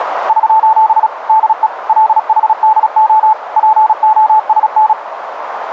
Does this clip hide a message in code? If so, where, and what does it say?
Yes: Morse code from 0.2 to 5.0 s, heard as a keyed tone, machine-sent, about 36 wpm, 870 Hz, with radio static and a narrow filter. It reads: <SOS> DE LHDO POSN